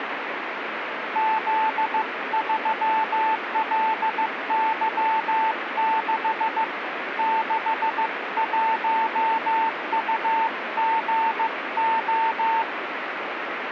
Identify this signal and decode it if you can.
Morse code, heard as a keyed tone, hand-sent with a paddle, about 15 wpm, 890 Hz, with radio static. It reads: Z3LY6 61UGO